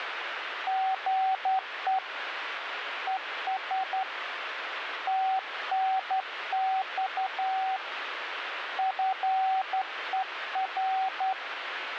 Morse code, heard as a keyed tone, hand-sent with a straight key, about 11 wpm, 760 Hz, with radio static. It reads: GE ES TNX FER